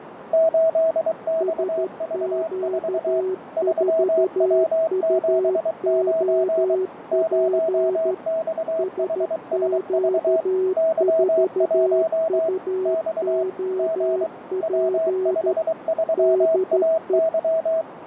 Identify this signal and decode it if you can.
Morse code, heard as two keyed tones, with radio static, fading and a narrow filter. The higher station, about 23 wpm, 650 Hz: 8XV4 3W79 0XHSV Y1 X G W53AY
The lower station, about 13 wpm, 370 Hz: SQ4UOP SQ4UOP DE